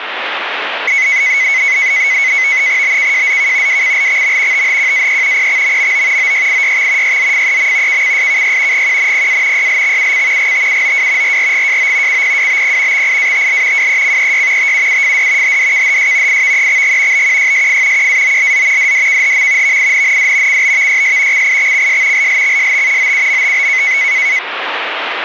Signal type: NAVTEX (SITOR-B)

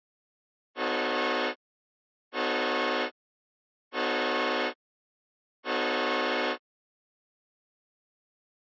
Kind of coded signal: train horn signal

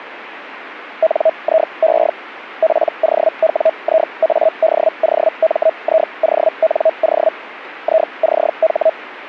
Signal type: Hellschreiber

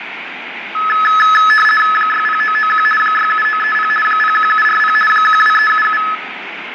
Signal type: RTTY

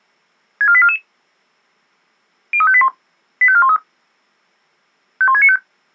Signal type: five-tone selective call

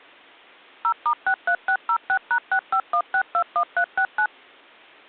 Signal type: DTMF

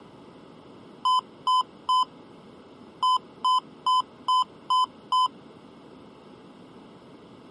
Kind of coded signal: beep code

